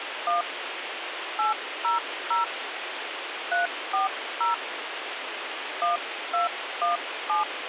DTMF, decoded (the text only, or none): 1 800 340 1217